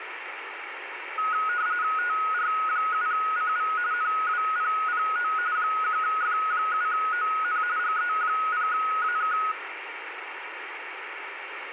RTTY (45.45 baud, 170 Hz shift), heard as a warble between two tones, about 1360 Hz centre, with radio static and room echo. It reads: TR7CV NWPPO 1F7ON GE0AK